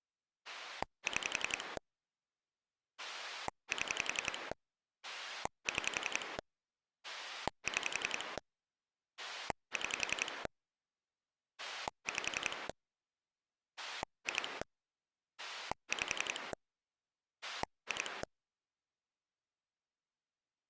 Pulse dialling, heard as a rotary dial, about 11 pulses a second. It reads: 6 7 6 6 6 5 2 5 2